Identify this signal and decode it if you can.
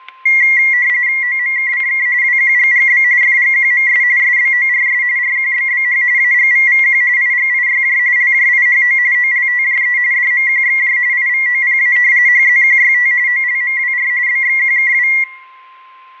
RTTY (45.45 baud, 170 Hz shift), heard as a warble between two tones, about 2050 Hz centre, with static crashes and a steady whistle near 1050 Hz. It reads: OMKCK WQGGB FGQMS SBORS RQBBH AGVVQ IGIYJ LJIHO OLTJE DMQXJ IVOPA HZQYT OLMWR BXQKW